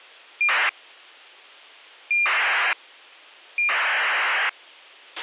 ACARS aircraft data, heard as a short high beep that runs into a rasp, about 2400 baud, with a squelch burst at the end.